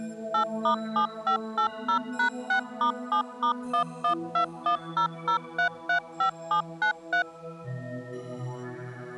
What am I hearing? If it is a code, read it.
DTMF, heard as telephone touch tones, dialled by machine, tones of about 100 ms. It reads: 8*7580#6*7*112100335793